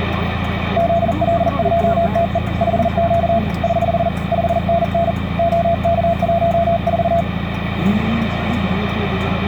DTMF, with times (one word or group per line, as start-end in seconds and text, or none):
none